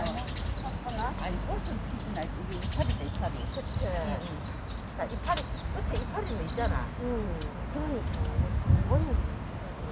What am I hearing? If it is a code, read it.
The noise of a park. There is no code.